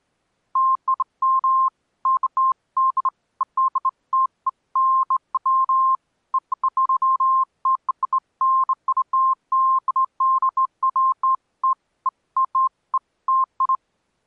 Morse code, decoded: none

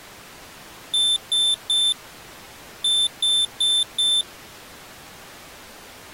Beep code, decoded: 3-4

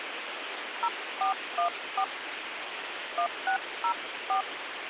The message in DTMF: 0414 1604

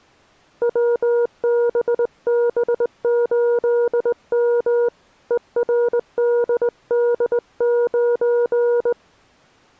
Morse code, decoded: WBB8M ERDD9

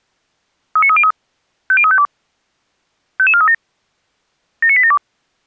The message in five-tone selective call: 39303 50352 55437 79872

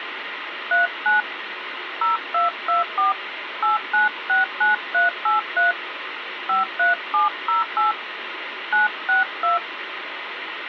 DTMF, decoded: 39 0224 8969383 53708 962

